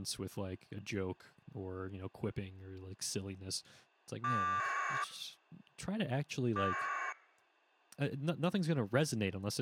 Packet radio (AX.25, as in APRS), 1200 baud, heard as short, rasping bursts, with speech in English.